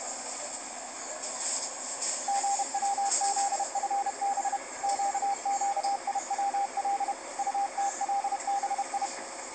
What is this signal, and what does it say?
Morse code, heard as a keyed tone, machine-sent, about 31 wpm, 800 Hz, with the noise inside a bus. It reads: GWZFB QQIWL UTLBI